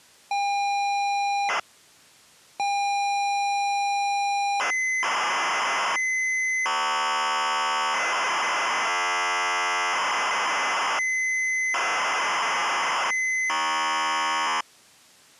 ZX Spectrum tape loading, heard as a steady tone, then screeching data.